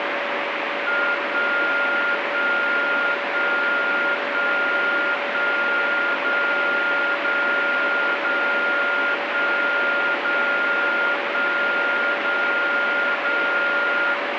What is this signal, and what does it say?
Radio time signal (DCF77), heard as a tone whose level steps once a second, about 1410 Hz, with radio static and a steady whistle near 570 Hz. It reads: 1 1 1 1 1 0 0 0 1 0 1 0 0